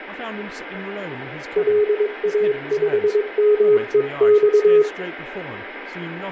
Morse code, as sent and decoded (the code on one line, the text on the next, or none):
.-.. .- ..... -- . -..-
LA5MEX